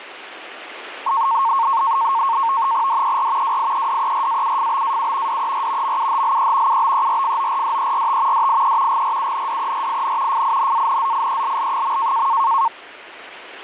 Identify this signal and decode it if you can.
NAVTEX (SITOR-B), 100 baud, 170 Hz shift, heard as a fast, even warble, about 1000 Hz centre, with radio static. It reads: DER WIEDERAUFBAU DER MUHLE UBERFORDERT DIE GRUNDERIN FINANZIELL.